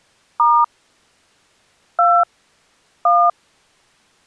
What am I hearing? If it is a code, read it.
DTMF, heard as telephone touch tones, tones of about 250 ms. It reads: * 2 1